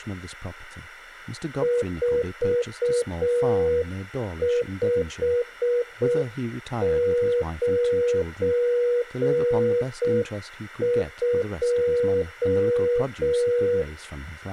Morse code, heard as a keyed tone, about 6 wpm, 480 Hz, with speech in English. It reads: 4592